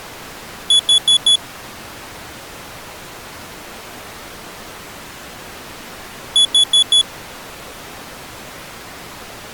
Alarm pattern, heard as an alarm's beeps, played twice, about 3400 Hz. Temporal four. Carbon monoxide.